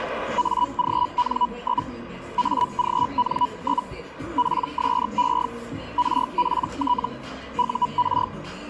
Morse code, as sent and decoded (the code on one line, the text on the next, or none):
none